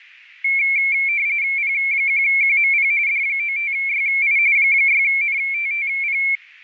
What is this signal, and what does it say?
RTTY (45.45 baud, 170 Hz shift), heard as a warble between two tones, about 2250 Hz centre. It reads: P1QMP D95YI 6NTTP